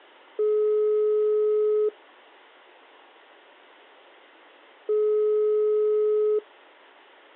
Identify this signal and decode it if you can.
Telephone call progress tone (single-tone plan, as in most of Europe), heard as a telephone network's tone, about 420 Hz, 1.5 s on and 3 s off. Ringback tone.